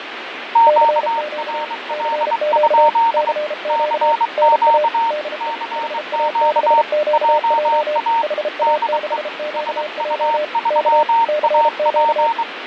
Morse code, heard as two keyed tones, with radio static and fading. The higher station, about 23 wpm, 920 Hz: QRL? CQ CQ JA DE SU3AP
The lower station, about 33 wpm, 600 Hz: CQ CQ CQ NA DE HA6QJ HA6QJ K CQ